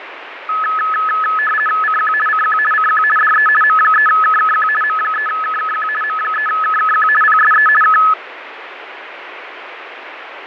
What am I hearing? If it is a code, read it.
RTTY (50 baud, 450 Hz shift), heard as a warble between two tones, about 1500 Hz centre, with radio static and fading. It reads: CQ CQ CQ DE M3KKQ M3KKQ M3KKQ PSE K